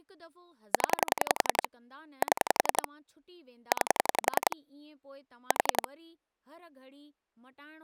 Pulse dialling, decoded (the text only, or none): 0 7 9 4